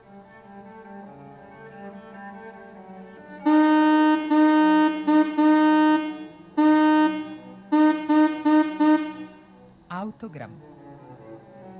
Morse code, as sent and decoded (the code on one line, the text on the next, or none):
--.- - ....
QTH